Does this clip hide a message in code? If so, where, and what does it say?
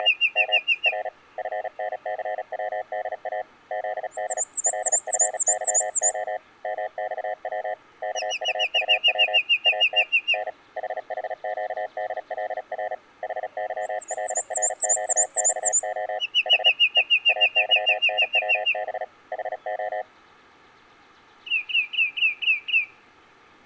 Yes: Morse code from 0.0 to 20.1 s, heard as a keyed tone, hand-sent with a paddle, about 36 wpm, 630 Hz. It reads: … M R FNCWDA ZD LFYO MXW KUUW AT N HHQDLR HYLRQXO H E AYNWB HO